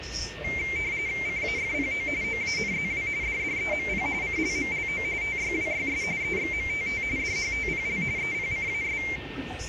RTTY (45.45 baud, 170 Hz shift), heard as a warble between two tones, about 2200 Hz centre, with radio static, a steady whistle near 1820 Hz and the noise inside a subway train. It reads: CAFPO OANZW DDEMP CLMLO TYWYS EXMTT DHTPL EPCAS